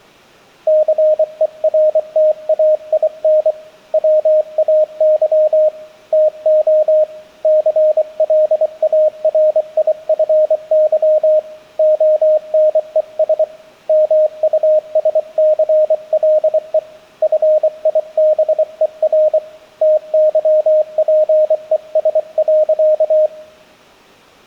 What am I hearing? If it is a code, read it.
Morse code, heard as a keyed tone, hand-sent with a paddle, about 24 wpm, 620 Hz. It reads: CERTAIN WAY TO CLARIFY ONES MUSCLE FIBER TYPES.